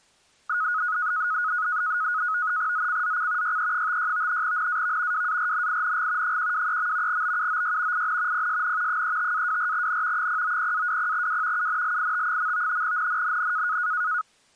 NAVTEX (SITOR-B), 100 baud, 170 Hz shift, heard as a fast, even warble, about 1360 Hz centre. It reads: ZCZC YE56 NAV WARNING 123. BUOY IN PSN 35-24N 090-20W UNLIT. NNNN